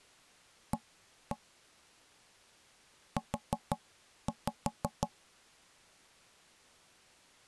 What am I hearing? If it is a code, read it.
Tap code, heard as knocks on wood, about 5 knocks a second. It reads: A U